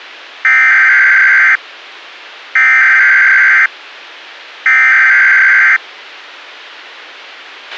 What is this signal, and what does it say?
Emergency Alert System (SAME) tones (header bursts), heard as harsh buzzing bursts, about 520.83 baud, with a squelch burst at the end.